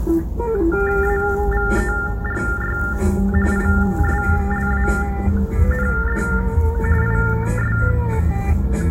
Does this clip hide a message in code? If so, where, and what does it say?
Yes: TTY/TDD text telephone tones (45.45 baud Baudot) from 0.7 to 7.9 s, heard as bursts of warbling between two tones, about 400 Hz shift, 1600 Hz centre, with room echo and the noise inside a car. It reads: AVERY ISLAND IS